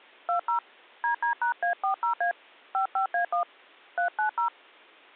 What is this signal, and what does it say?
DTMF, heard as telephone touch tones, dialled by hand, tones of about 110 ms. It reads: 20 DD#A40A 55A1 390